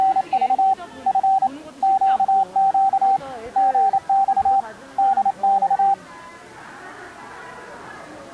Morse code, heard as a keyed tone, hand-sent with a paddle, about 28 wpm, 780 Hz, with the noise of a crowd indoors. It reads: … F QQ GX DX